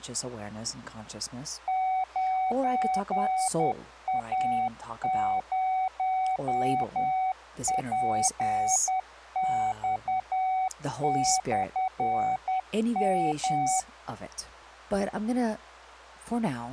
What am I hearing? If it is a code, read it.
Morse code, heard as a keyed tone, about 10 wpm, 750 Hz, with speech in English. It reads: 9A0PX/M